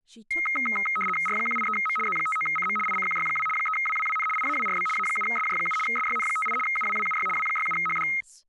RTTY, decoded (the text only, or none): R183M Z59CM ICQY2 3WWWN IAWRB A7SJ7 SYN58 UWWUY W67HD